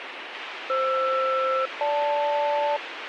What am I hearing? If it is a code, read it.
Aircraft SELCAL, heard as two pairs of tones, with radio hiss. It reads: FR-GL